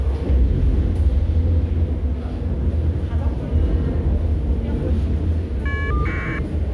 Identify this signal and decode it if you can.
Caller ID data burst, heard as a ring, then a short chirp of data, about 1200 baud, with the noise of a subway station.